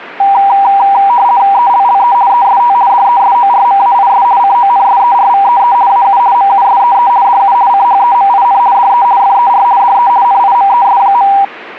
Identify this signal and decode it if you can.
RTTY (50 baud, 170 Hz shift), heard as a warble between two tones, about 880 Hz centre. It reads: ELLE EST DESORMAIS CONSERVEE AU MUSEE DU CHEMIN DE FER DE NIMES.